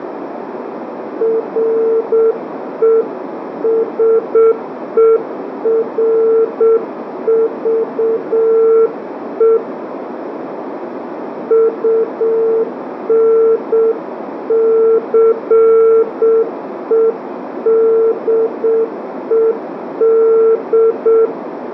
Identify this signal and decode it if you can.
Morse code, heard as a keyed tone, hand-sent with a straight key, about 7 wpm, 450 Hz, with radio static, fading, a narrow filter and room echo. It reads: RESERVE UNCEDED